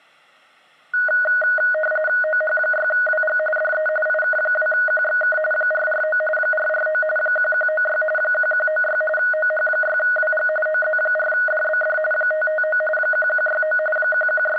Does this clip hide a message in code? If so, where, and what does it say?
Yes: RTTY (45.45 baud, 850 Hz shift) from 0.9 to 14.6 s, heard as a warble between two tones, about 1050 Hz centre, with room echo. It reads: OH6WG DE IK2QXK 449 449 1196 1196 OH6WG OZ4DBD 559 1169 …